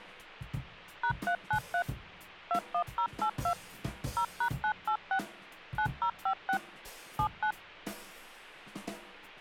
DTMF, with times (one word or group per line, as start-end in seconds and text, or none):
1.0-1.8 #393
2.5-3.5 21082
4.2-5.2 0#986
5.8-6.6 9056
7.2-7.5 79